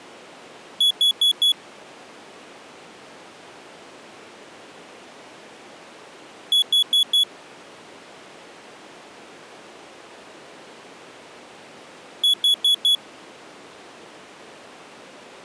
Alarm pattern, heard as an alarm's beeps, played three times, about 3400 Hz. Temporal four. Carbon monoxide.